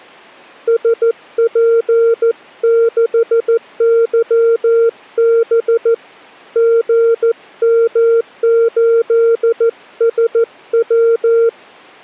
Morse code, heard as a keyed tone, hand-sent with a paddle, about 14 wpm, 460 Hz. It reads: SP6YB GM8SW